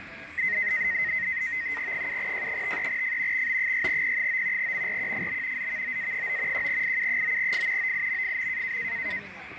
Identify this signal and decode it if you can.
NAVTEX (SITOR-B), 100 baud, 170 Hz shift, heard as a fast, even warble, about 1950 Hz centre, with radio static and the noise of a restaurant. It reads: 7J53F XB6P9 MRQFB ZVOA9 1IU9F OIMFM